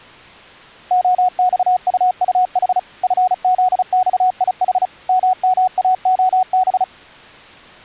Morse code, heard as a keyed tone, machine-sent, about 35 wpm, 740 Hz. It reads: OXUUH FZXIH MMAOB